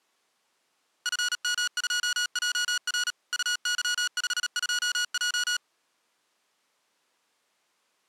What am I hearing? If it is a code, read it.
Morse code, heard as electronic beeps, machine-sent, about 37 wpm, 1450 Hz. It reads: FM2JR UY52J